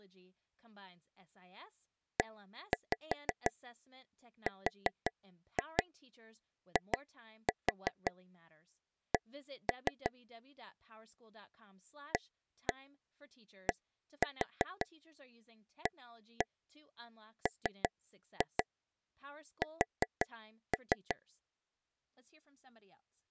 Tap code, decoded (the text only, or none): ERIC ADAMS